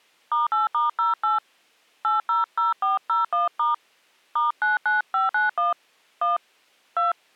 DTMF, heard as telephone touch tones, dialled by hand, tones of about 150 ms. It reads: *8*08 800401* *99591 1 2